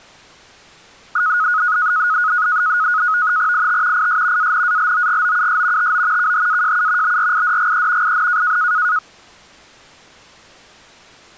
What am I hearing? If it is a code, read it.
NAVTEX (SITOR-B), 100 baud, 170 Hz shift, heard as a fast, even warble, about 1360 Hz centre. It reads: IT IS ANALOGOUS TO KHAJU BRIDGE IN